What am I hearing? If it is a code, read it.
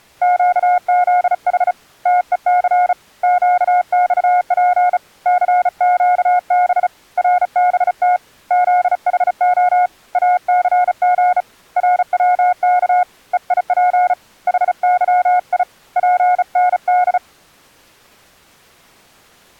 Morse code, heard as a keyed tone, hand-sent with a bug key, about 35 wpm, 720 Hz. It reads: QZH TEC QXP CQB RBT ZHO ACG RWK EIP HYI PND